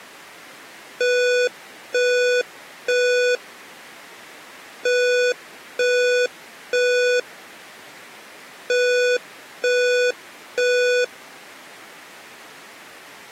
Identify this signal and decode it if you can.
Alarm pattern, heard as an alarm's beeps, played three times, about 490 Hz. Temporal three. Smoke or fire, evacuate.